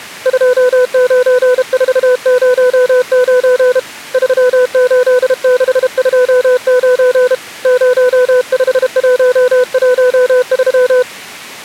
Morse code, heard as a keyed tone, hand-sent with a paddle, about 32 wpm, 500 Hz. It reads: 29409 38629 05113